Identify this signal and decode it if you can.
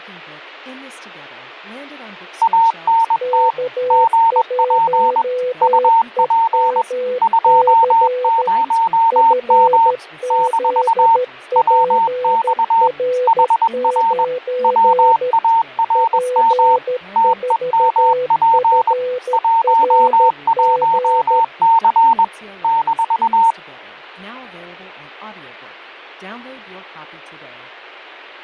Morse code, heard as two keyed tones, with speech in English. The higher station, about 21 wpm, 910 Hz: ANT GP UP 20M - WX HR WARM TEMP 11C -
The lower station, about 13 wpm, 500 Hz: K1EMC FZPR9 P4FRG